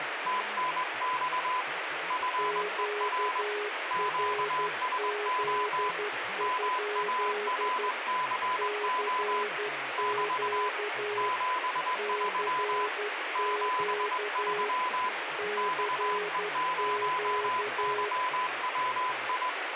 Morse code, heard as two keyed tones, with radio static and speech in English. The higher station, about 21 wpm, 1010 Hz: TNX FER QSO MARCO <BT> 73 73 XE0YWI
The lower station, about 12 wpm, 420 Hz: QRZ? CQ CQ CQ